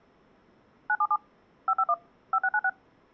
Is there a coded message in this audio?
Yes: DTMF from 0.9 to 2.7 s, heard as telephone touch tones, dialled by machine, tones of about 60 ms. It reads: 977 551 5696